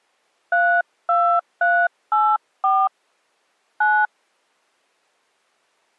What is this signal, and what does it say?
DTMF, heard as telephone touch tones, dialled by hand, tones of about 270 ms. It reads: 32384 9